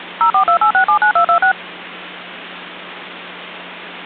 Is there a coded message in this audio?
Yes: DTMF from 0.2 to 1.5 s, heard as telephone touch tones, dialled by machine, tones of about 90 ms, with hum. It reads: 0428679226